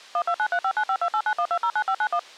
DTMF, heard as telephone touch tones, dialled by machine, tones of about 70 ms. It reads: 12935952891209591